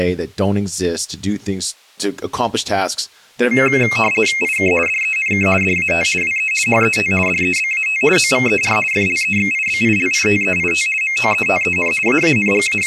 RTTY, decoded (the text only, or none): IK DENK DAT WE HET DEBAT OVER FLEXIBILITEIT MOETEN …